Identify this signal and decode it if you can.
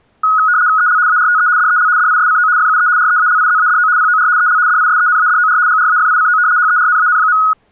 RTTY (75 baud, 170 Hz shift), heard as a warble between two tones, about 1360 Hz centre. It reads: EL ARTE DEL DISCO FUE REALIZADO POR EL DISENADOR GRAFICO HERNAN.